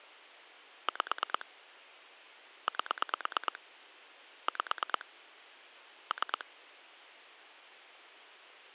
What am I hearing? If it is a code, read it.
Pulse dialling, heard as clicks on a phone line, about 9 pulses a second. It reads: 5 8 5 3